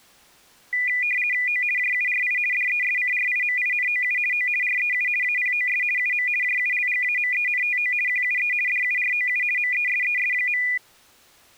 RTTY (50 baud, 450 Hz shift), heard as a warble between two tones, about 2200 Hz centre. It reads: O JURI DESCRIMINOU O REU APOS UM JULGAMENTO QUE DUROU MESES.